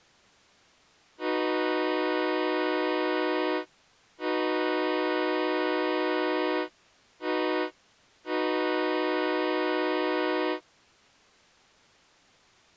Train horn signal, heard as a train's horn. 2 long, 1 short, 1 long. On North American railways: approaching a public crossing.